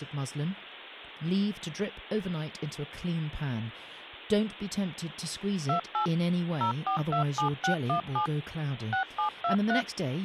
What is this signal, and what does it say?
DTMF, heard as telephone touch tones, dialled by machine, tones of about 100 ms, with speech in English. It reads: 28 0427617 6723